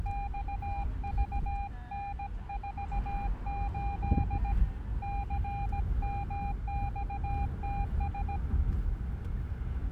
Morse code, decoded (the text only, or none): XVN48 CMXTS